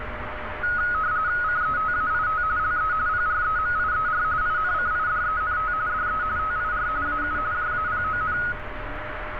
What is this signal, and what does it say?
RTTY (45.45 baud, 170 Hz shift), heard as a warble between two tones, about 1360 Hz centre, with radio static, a steady whistle near 610 Hz and street noise. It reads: CETAIT LE PREMIER INCIDENT DE TIR AU JAPON